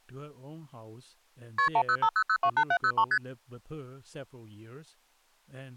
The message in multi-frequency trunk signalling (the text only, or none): KP 1050028703 ST